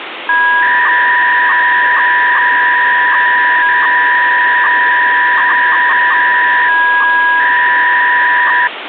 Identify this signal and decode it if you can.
300-baud modem data (V.21 tones), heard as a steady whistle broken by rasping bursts, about 300 baud, 200 Hz shift, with phone line noise.